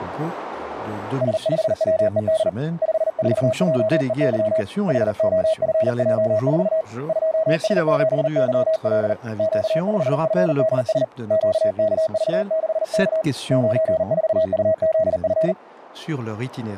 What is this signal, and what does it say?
Morse code, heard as a keyed tone, hand-sent with a paddle, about 39 wpm, 640 Hz. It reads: S5WED 54JEY HOFJ4 2S7YL Q5FDS QKV6K 94UZF